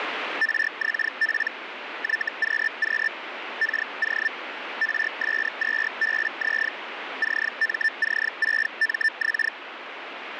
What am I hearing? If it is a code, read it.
Hellschreiber (Feld-Hell, 122.5 baud), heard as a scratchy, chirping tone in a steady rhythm, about 1800 Hz, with radio static. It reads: RXP YQQ KO RS2BZ CMC6MX